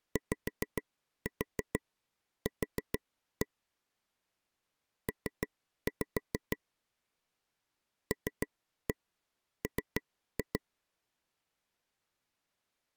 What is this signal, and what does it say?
Tap code, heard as taps on a table, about 6 knocks a second. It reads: YQ P LM